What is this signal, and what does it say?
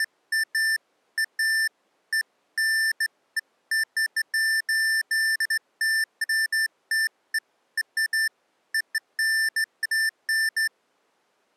Beeps of irregular length. There is no code.